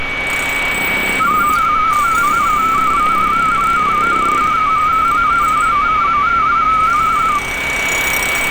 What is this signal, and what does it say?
Multi-tone FSK (Olivia or MFSK type), about 250 Hz wide, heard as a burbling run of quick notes, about 31.25 baud, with radio static, a steady whistle near 2260 Hz and street noise.